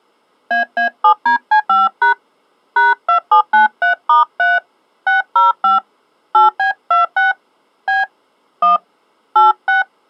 DTMF, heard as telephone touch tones, dialled by hand, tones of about 140 ms. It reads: AA7DC5# #2793*3 605 8B26 B 1 86